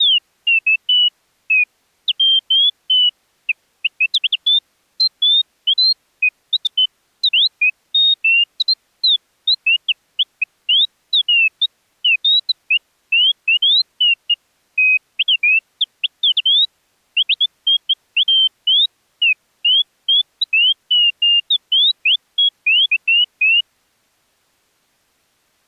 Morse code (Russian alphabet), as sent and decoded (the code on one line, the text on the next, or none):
none